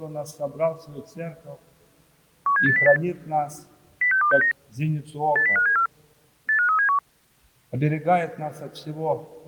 Five-tone selective call (CCIR), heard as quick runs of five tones, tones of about 100 ms. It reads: 17808 06269 80574 85371